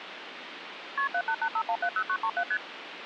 Multi-frequency trunk signalling (R1, as on North American trunks), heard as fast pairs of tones, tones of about 70 ms, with phone line noise. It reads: KP 7885170937 ST